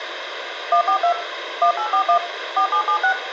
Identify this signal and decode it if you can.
DTMF, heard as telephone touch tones, dialled by machine, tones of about 90 ms, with phone line noise and room echo. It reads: 142 1841 4776